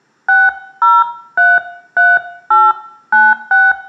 DTMF, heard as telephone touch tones, dialled by hand, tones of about 210 ms, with room echo. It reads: 6033896